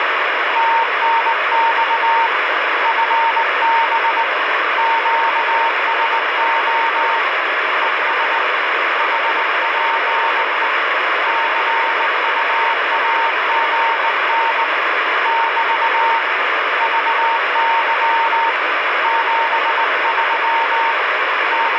Morse code, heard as a keyed tone, hand-sent with a bug key, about 19 wpm, 920 Hz, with heavy radio static. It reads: TNX FB QSO ES HPE CUAGN <BT> VY 73 …